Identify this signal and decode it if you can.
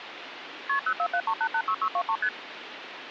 Multi-frequency trunk signalling (R1, as on North American trunks), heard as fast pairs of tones, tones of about 70 ms, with phone line noise. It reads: KP 0473886623 ST